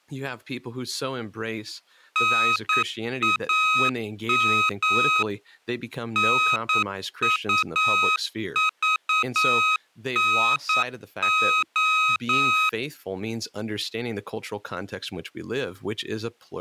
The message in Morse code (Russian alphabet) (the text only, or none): НАМ НУЖНО